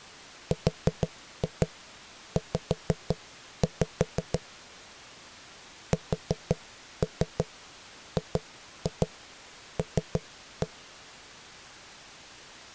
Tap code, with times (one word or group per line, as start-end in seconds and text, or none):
0.5-4.4 RZ
5.9-10.7 SGL